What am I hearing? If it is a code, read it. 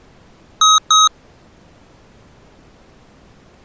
Beep code, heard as beeps from a small speaker, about 1270 Hz. 2 short. In AMI BIOS tables: memory parity error; in IBM BIOS tables: self-test error shown on screen; in Dell tables: no memory detected.